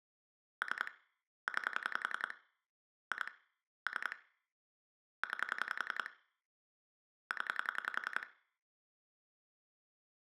Pulse dialling, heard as clicks on a phone line, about 10 pulses a second, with room echo. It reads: 3 9 2 3 9 0